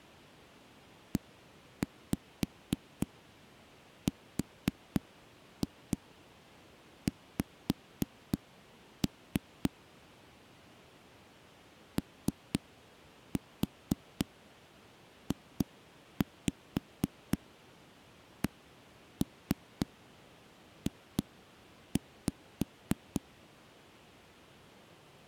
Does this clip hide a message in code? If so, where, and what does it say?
Yes: tap code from 1.1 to 23.2 s, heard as knocks on a wall, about 3 knocks a second. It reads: ERX OJCJ